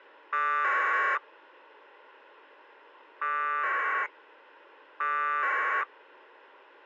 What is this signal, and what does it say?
Packet radio (AX.25, as in APRS), 1200 baud, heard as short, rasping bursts.